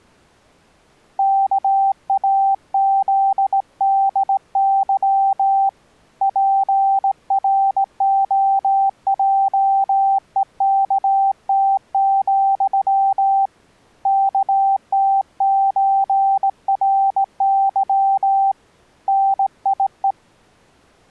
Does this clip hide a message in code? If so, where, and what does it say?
Yes: Morse code (with Polish letters) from 1.1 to 20.2 s, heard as a keyed tone, hand-sent with a straight key, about 18 wpm, 780 Hz. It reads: KAZDY PROJEKT, KTÓRY NIE